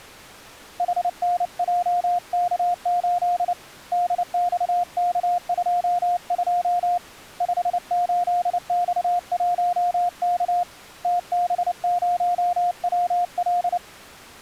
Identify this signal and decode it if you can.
Morse code, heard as a keyed tone, hand-sent with a paddle, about 29 wpm, 710 Hz. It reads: HNJK8 DXK22 58X1K TB0WL